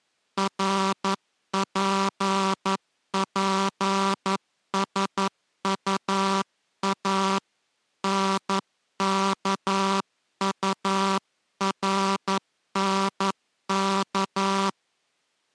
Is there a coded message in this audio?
Yes: Morse code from 0.3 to 14.8 s, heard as a buzzer, hand-sent with a paddle, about 11 wpm. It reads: RPPSUA NKURNK